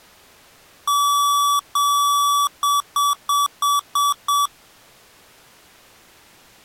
Beep code, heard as beeps from a small speaker, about 1150 Hz. 2 long, 6 short.